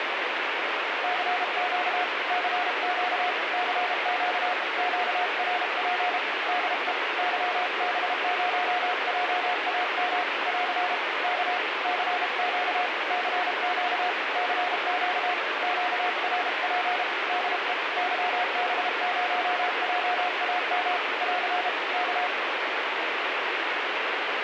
Morse code, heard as a keyed tone, hand-sent with a paddle, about 32 wpm, 720 Hz, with heavy radio static. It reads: CQ CQ CQ QRP DE YB0JAM <AR> K CQ CQ CQ QRP DE YB0JAM <AR> K